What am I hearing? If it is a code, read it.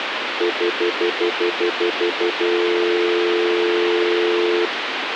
Telephone call progress tone (North American plan), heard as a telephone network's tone, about 350, 440 Hz, 0.1 s on and 0.1 s off, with phone line noise. Stutter dial tone.